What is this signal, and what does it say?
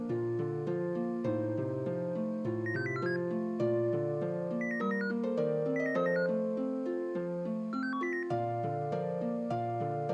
Five-tone selective call (CCIR), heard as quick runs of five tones, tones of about 100 ms. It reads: 96047 09395 09395 46109